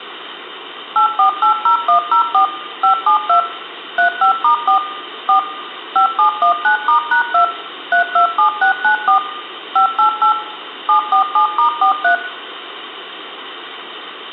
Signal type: DTMF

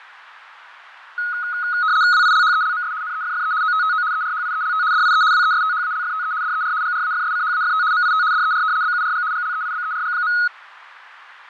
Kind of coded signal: RTTY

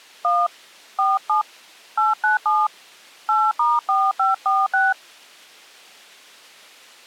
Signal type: DTMF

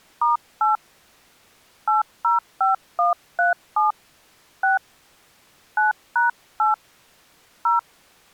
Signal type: DTMF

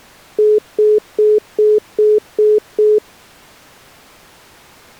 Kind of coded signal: telephone call progress tone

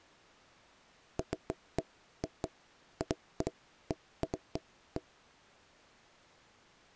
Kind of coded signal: none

